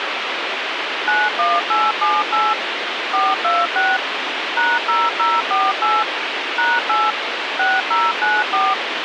DTMF, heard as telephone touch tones, dialled by machine, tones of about 210 ms, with radio hiss. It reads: 91878 426 #0048 #8 6094